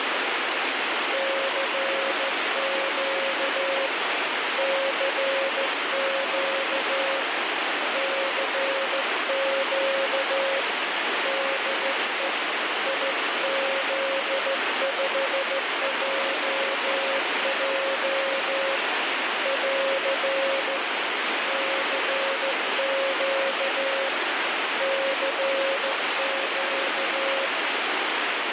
Morse code, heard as a keyed tone, hand-sent with a straight key, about 14 wpm, 540 Hz, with heavy radio static. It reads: CQ CQ CQ DE IZ5JJ <AR> CQ CQ